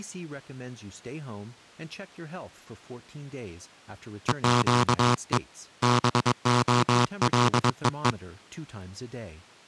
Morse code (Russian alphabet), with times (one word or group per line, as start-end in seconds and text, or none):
4.3-5.4 ЕЩЕ
5.8-8.1 БОЛЕЕ